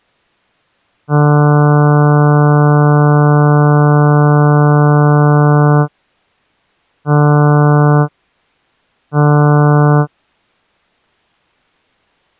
Ship horn signal, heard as a ship's horn, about 150 Hz. 1 long, 2 short. At sea: a vessel in fog that is sailing, fishing, towing or hampered.